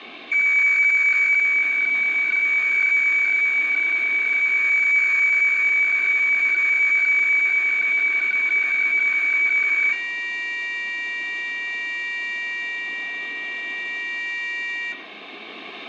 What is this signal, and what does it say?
Weather fax (radiofax), 120 lines a minute, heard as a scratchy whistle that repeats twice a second, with radio static and room echo.